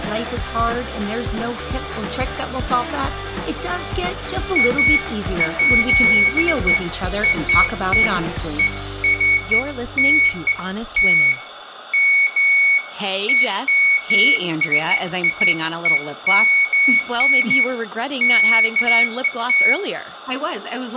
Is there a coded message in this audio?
No, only beeps of irregular length, with room echo.